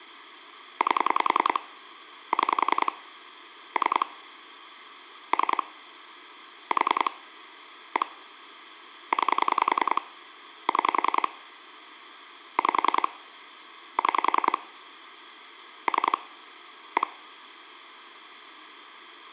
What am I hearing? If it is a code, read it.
Pulse dialling, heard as clicks on a phone line, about 10 pulses a second. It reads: 8 6 3 3 4 1 9 6 5 6 3 1